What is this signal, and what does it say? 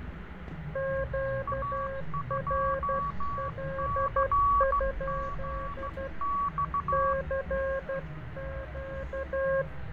Morse code, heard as two keyed tones, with radio static, fading and street noise. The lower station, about 12 wpm, 540 Hz: QRL? CQ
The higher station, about 15 wpm, 1130 Hz: A2CGX